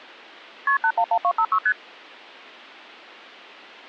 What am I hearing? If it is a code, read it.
Multi-frequency trunk signalling (R1, as on North American trunks), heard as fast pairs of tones, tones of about 70 ms. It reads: KP 811256 ST